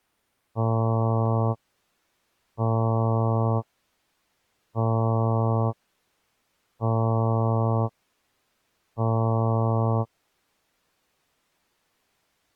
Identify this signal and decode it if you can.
Ship horn signal, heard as a ship's horn, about 110 Hz. 5 short. At sea: I doubt that you are doing enough to avoid a collision.